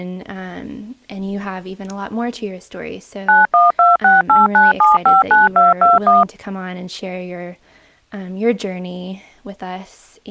DTMF, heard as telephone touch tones, dialled by machine, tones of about 170 ms, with speech in English. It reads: 912689759221